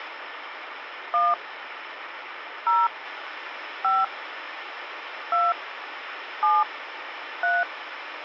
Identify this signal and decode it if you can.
DTMF, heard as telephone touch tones, dialled by hand, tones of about 200 ms, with phone line noise. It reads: 1 0 5 2 7 3